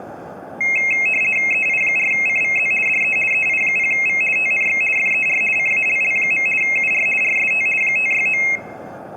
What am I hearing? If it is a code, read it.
RTTY (50 baud, 450 Hz shift), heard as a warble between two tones, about 2350 Hz centre. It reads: EI4CVZ DE EI0V TNX FER CALL. UR RST 569